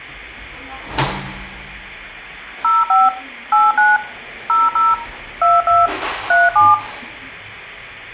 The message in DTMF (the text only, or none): 05 89 00 22 37